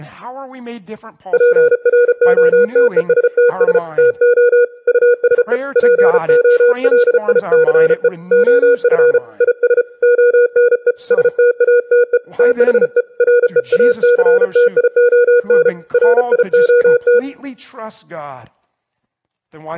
Morse code, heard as a keyed tone, hand-sent with a paddle, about 34 wpm, 480 Hz, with speech in English. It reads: PROTESTS TO USE POLICE OF IS ONE STATE THE REACTION RIOT